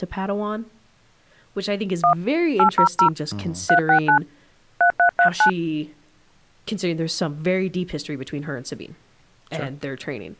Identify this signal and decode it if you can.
DTMF, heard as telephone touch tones, dialled by hand, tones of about 100 ms, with speech in English. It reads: 1 800 369 3339